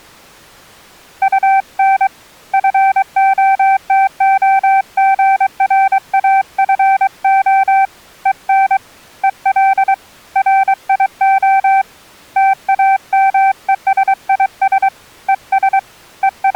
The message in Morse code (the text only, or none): UN FOTOGRAFO EN EL RIO TAMESIS ES …